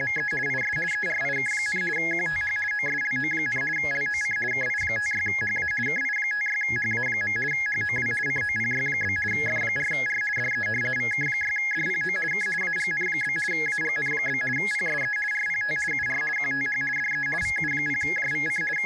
RTTY (50 baud, 450 Hz shift), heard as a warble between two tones, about 1900 Hz centre, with a steady whistle near 840 Hz. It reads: … IS ERIK, QTH OSLO, LOC KI56HA KI56HA. HOW COPY? F4R DE VK6DPO K AGN? AGN? PSE RPT UR QTH DE VU0JVC …